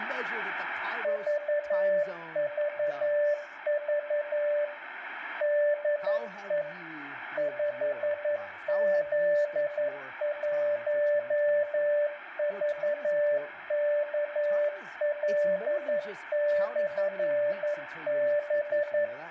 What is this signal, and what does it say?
Morse code, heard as a keyed tone, machine-sent, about 11 wpm, 590 Hz, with room echo and speech in English. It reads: VVV DE 5Z1VKL/B